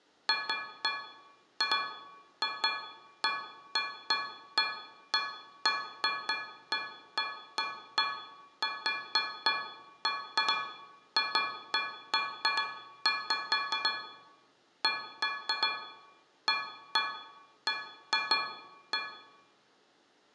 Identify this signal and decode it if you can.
Irregular taps on a metal pipe, with room echo. There is no code.